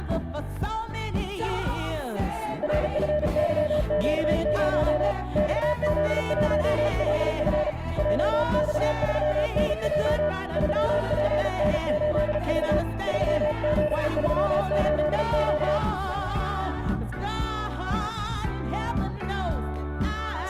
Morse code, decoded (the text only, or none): RFYQ0 XZ1LF JX3NJ 3PN8V 3738Q